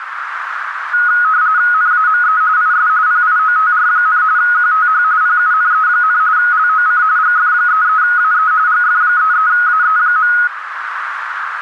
RTTY (45.45 baud, 170 Hz shift), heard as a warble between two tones, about 1360 Hz centre, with radio static and a narrow filter. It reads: NAME IS PIOTR, QTH PUNE, LOC GF33AE GF33AE.